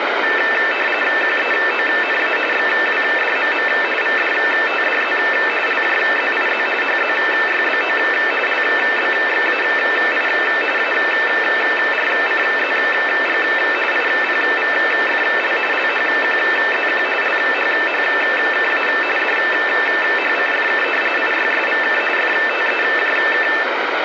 RTTY (45.45 baud, 850 Hz shift), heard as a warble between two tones, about 2200 Hz centre, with radio static. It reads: QEONA XWDMM VDTDZ LJZIZ HZYBO LBXAI ARCZG IPVFL LHQZQ LHHKA DHCFK IYSVK FTEJK